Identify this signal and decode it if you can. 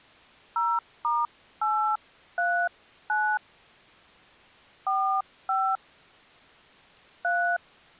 DTMF, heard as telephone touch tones, dialled by hand, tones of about 250 ms. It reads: 0*839 45 3